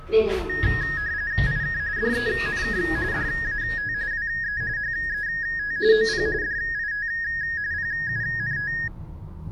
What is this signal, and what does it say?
RTTY (45.45 baud, 170 Hz shift), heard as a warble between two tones, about 1750 Hz centre, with the noise inside a lift. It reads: IK DENK DAT WE HET OP DIT PUNT